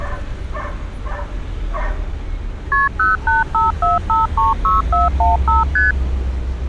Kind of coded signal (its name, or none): multi-frequency trunk signalling